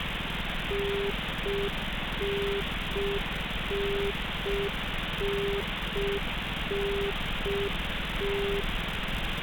Telephone call progress tone (UK plan), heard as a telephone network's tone, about 400 Hz, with phone line noise and street noise. Congestion tone.